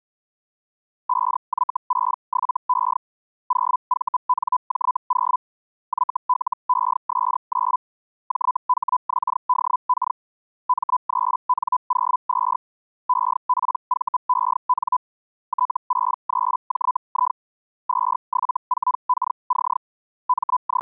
Hellschreiber (Feld-Hell, 122.5 baud), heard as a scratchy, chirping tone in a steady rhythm, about 1000 Hz. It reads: 5Y67E 0VNJ0 YLES9 JHXDK M3N02 EPVEN T63JI 274KC …